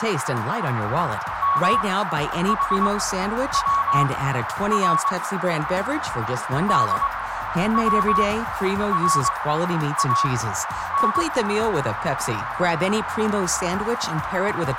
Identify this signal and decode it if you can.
Morse code (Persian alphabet), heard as a keyed tone, machine-sent, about 22 wpm, spaced as for 10 wpm, 1110 Hz, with radio static and a narrow filter. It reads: محور دوران